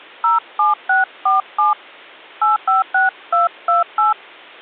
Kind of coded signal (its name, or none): DTMF